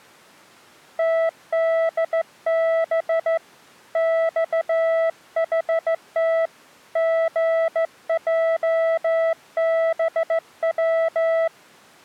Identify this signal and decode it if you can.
Morse code, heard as a keyed tone, hand-sent with a straight key, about 15 wpm, 660 Hz. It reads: TDB XHT GJBW